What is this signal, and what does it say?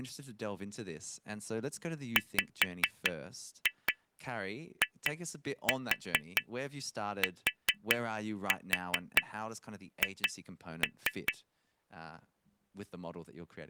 Tap code, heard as taps on glass, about 4 knocks a second, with speech in English. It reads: WITH